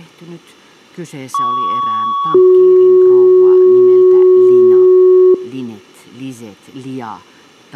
Two-tone page, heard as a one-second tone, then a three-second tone, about 1120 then 370 Hz, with speech in Finnish.